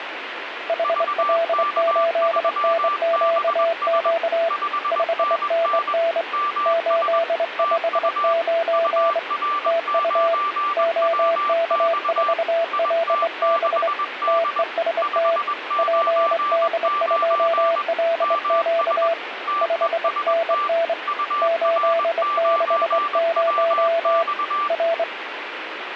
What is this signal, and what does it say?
Morse code, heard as two keyed tones, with radio static. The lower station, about 24 wpm, 670 Hz: HL8NQQ 5NN 859 TU OK4LB TEST PD2LQ 5NN 860 R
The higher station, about 21 wpm, 1170 Hz: VK3BS 5NN MS TU UR9WX IT6D 599 MS TEST UR9WX